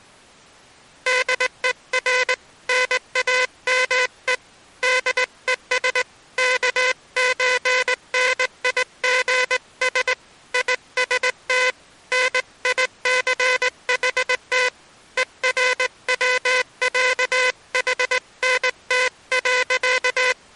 Morse code (with German letters), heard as a buzzer, hand-sent with a straight key, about 19 wpm. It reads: DER NAME DES KÖNIGS IST NICHT ERWÄHNT.